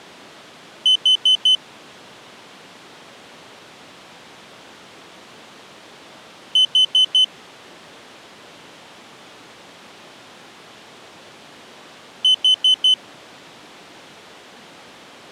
Alarm pattern, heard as an alarm's beeps, played three times, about 3050 Hz. Temporal four. Carbon monoxide.